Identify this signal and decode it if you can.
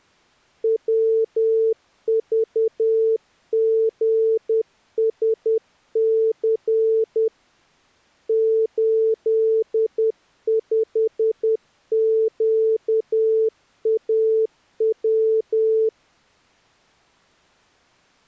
Morse code, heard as a keyed tone, hand-sent with a paddle, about 10 wpm, 440 Hz. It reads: WVGSC 85QAW